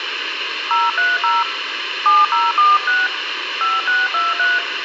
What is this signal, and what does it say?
DTMF, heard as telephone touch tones, dialled by hand, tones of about 190 ms, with radio hiss and a squelch burst at the end. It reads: 030 7046 5623